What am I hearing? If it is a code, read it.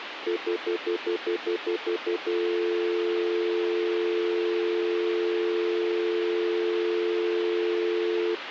Telephone call progress tone (North American plan), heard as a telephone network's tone, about 350, 440 Hz, 0.1 s on and 0.1 s off, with phone line noise. Stutter dial tone.